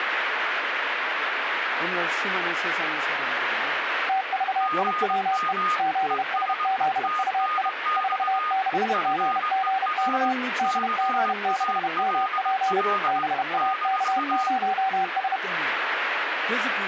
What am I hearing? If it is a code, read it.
Morse code, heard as two keyed tones, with radio static and speech in Korean. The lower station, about 31 wpm, 770 Hz: TVIWE ZSZUI 46GGK DG6MP BAK0S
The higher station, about 20 wpm, 1230 Hz: GM ES TNX FER CALL -